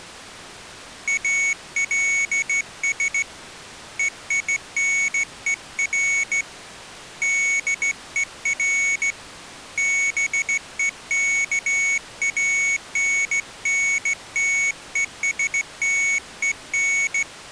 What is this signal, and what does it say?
Morse code, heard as a high beeper, hand-sent with a straight key, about 15 wpm, 2200 Hz. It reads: ALS EINER DER BEKANNTESTEN